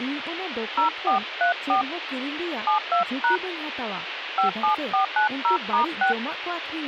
DTMF, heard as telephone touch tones, dialled by hand, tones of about 120 ms, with phone line noise and speech in Santali. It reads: 0434 72# 57490*6